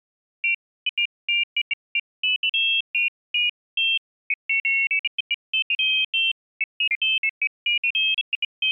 Pairs of high tones at irregular times. There is no code.